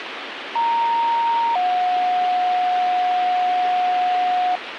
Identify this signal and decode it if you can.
Two-tone page, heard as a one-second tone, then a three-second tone, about 930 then 730 Hz, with radio hiss.